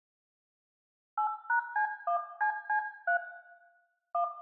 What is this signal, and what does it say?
DTMF, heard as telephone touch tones, dialled by hand, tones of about 100 ms, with room echo. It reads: 8#C1CC3 1